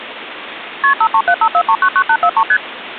Multi-frequency trunk signalling (R1, as on North American trunks), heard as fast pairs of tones, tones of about 70 ms, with phone line noise. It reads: KP 53754399843 ST